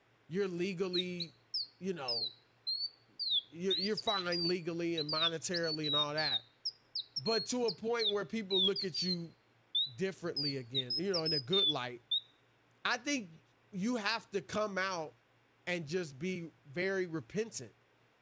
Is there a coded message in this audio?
No, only bird-like chirps, with speech in English.